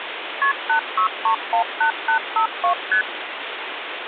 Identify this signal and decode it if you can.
Multi-frequency trunk signalling (R1, as on North American trunks), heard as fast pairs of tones, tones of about 100 ms, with phone line noise. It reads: KP 86318852 ST